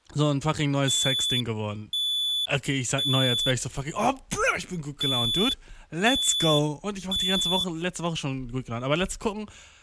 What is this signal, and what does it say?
Alarm pattern, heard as an alarm's beeps, played twice, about 3450 Hz, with speech in German. Temporal three. Smoke or fire, evacuate.